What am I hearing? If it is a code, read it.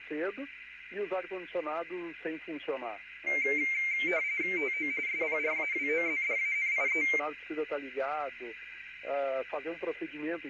RTTY (45.45 baud, 170 Hz shift), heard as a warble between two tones, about 2200 Hz centre, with radio static and a narrow filter. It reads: TO SPRAWOZDANIE